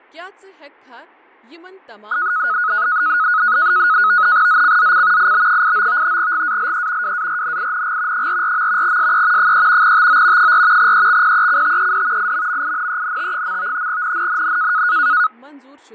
NAVTEX (SITOR-B), 100 baud, 170 Hz shift, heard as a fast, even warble, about 1360 Hz centre, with fading and speech in Kashmiri. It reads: ZCZC IB89 GALE WARNING 44. SE 3 TO 4 EXPECTED IMMINENT. NNNN